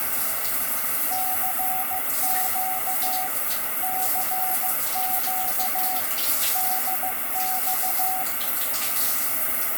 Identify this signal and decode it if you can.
Morse code, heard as a keyed tone, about 15 wpm, 750 Hz, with radio static and the noise of a restroom. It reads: CQ CQ DX